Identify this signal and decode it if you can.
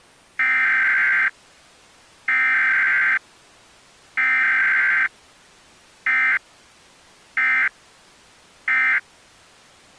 Emergency Alert System (SAME) tones (header bursts, then end-of-message bursts), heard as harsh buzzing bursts, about 520.83 baud.